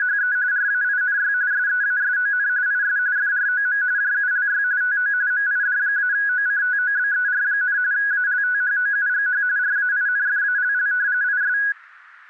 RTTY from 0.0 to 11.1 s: … RAINY SEASON IS FROM JULY TO MID-OCTOBER, ALTHOUGH RAINFALL

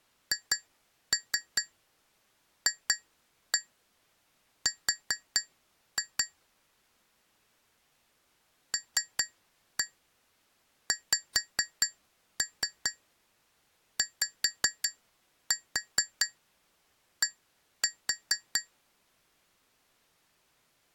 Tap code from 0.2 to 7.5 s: HFR

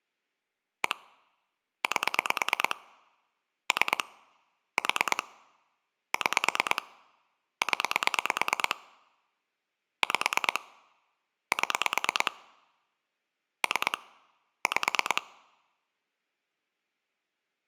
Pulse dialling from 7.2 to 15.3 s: 0 5 7 3 5

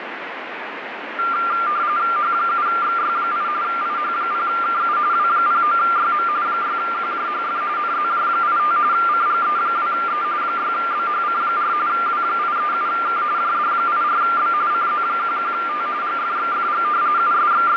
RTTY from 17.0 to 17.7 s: …

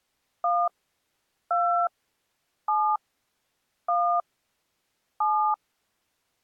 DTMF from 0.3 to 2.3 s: 1 2

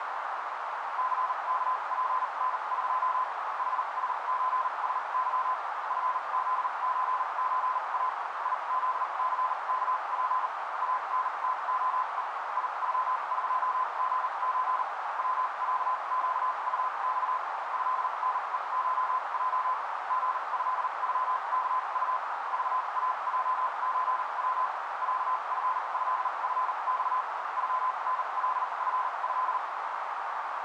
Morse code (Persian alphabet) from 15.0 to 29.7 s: وصگطخ ضنهشج ژضغکط ذاجچو صفضفخ غنلفض

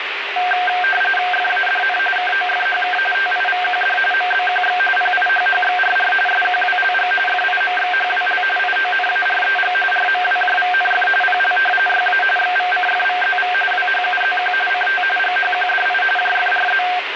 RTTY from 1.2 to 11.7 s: FADN KOFHK TIVQD MBQX PIHHXRR SQWLG FIMXHWL IONAREG RMWJVNF PL

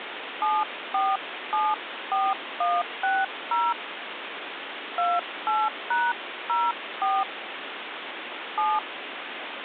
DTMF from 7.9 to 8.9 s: 7

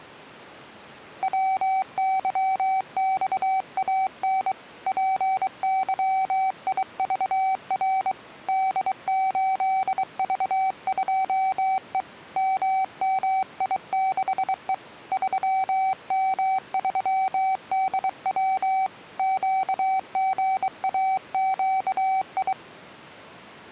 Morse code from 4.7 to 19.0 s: PYIVR D8V2E MMI6E 3M3DW

